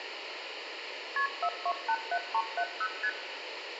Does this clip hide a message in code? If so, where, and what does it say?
Yes: multi-frequency trunk signalling (R1, as on North American trunks) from 1.2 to 3.1 s, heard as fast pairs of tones, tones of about 60 ms, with phone line noise and room echo. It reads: KP 4287370 ST